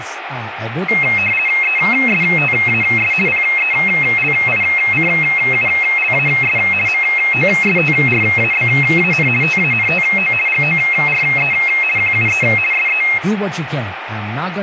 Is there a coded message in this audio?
Yes: RTTY (50 baud, 450 Hz shift) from 0.9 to 13.2 s, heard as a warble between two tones, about 2350 Hz centre, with radio static, room echo and speech in English. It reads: ESTAS PELICULAS MOSTRABAN TANTO GORE QUE SE